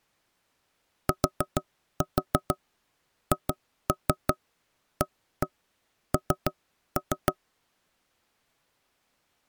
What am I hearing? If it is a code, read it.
Tap code, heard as knocks on wood, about 6 knocks a second. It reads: THAN